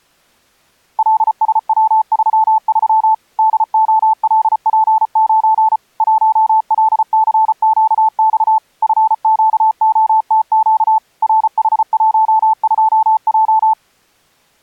Morse code, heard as a keyed tone, machine-sent, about 34 wpm, 880 Hz. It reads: LSW33 DOLP9 1LCQX FQOTQ RH12J